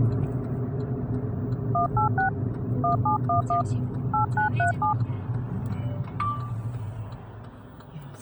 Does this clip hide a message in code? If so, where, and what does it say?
Yes: DTMF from 1.7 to 4.9 s, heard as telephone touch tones, dialled by hand, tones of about 120 ms, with the noise inside a car. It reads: 186 1711 8937